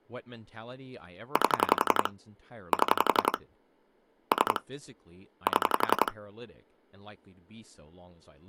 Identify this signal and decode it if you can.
Pulse dialling, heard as clicks on a phone line, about 11 pulses a second, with speech in English. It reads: 8 7 3 7